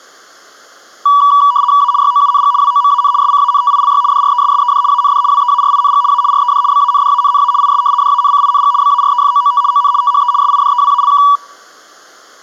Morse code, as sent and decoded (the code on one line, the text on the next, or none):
none